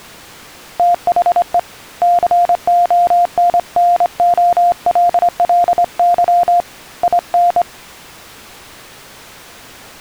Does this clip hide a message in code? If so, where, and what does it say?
Yes: Morse code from 0.7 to 7.7 s, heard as a keyed tone, hand-sent with a straight key, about 24 wpm, 700 Hz. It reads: THE CONNOLLY IN